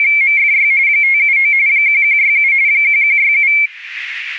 RTTY (45.45 baud, 170 Hz shift), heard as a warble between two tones, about 2250 Hz centre. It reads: … 579 1167 1167